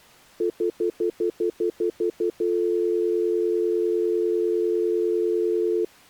Telephone call progress tone (North American plan), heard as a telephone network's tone, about 350, 440 Hz, 0.1 s on and 0.1 s off. Stutter dial tone.